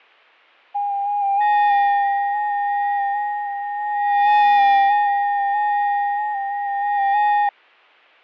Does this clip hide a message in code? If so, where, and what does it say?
Yes: FT8 (several signals at once) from 0.7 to 7.5 s, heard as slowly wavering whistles, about 6.25 baud, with fading.